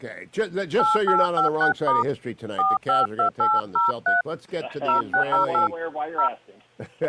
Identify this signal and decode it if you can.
DTMF, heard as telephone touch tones, dialled by hand, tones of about 160 ms. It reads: 8856* 452803 0608 0